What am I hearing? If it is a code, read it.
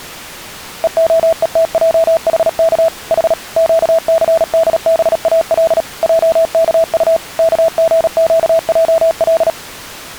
Morse code (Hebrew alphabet), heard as a keyed tone, machine-sent, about 37 wpm, 660 Hz. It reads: והותעחך ח קסדבאל עכט כגקעל